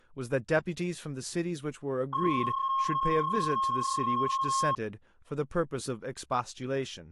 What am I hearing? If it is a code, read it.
PSK31 (31.25 baud), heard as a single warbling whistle, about 1080 Hz, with speech in English.